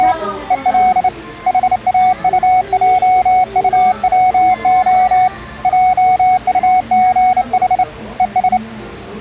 Morse code (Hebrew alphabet), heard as a keyed tone, hand-sent with a straight key, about 28 wpm, 740 Hz, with the noise of a cafe. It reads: … ול חאטעטצה עטגח וש